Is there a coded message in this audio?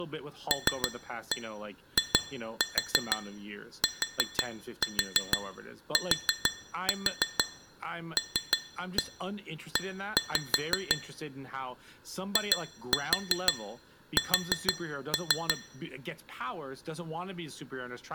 Yes: tap code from 0.5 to 15.6 s, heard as taps on glass, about 6 knocks a second, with speech in English. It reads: LITTLE IS